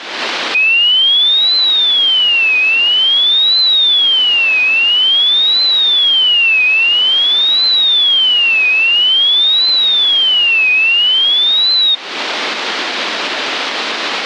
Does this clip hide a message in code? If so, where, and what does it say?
No, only a tone that sweeps in pitch again and again, with radio static.